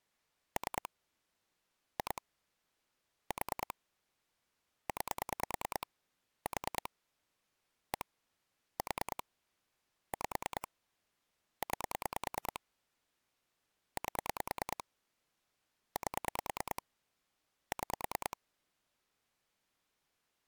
Pulse dialling, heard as clicks on a phone line, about 9 pulses a second. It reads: 3 2 4 9 4 1 4 5 9 8 8 6